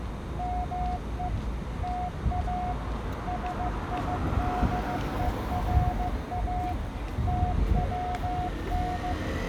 Morse code (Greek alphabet), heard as a keyed tone, machine-sent, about 15 wpm, 720 Hz, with the noise of a residential street. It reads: ΜΕ ΤΑ ΣΙΔΕΡΑ ΤΩΝ